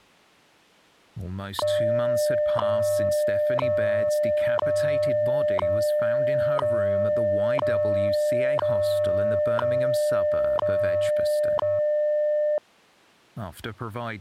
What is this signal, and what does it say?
Radio time signal (WWV, Colorado), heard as ticks, one a second, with speech in English.